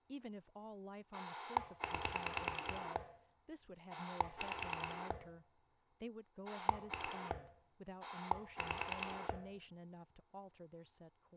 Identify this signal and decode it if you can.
Pulse dialling, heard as a rotary dial, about 9 pulses a second, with room echo and speech in English. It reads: 9 5 2 5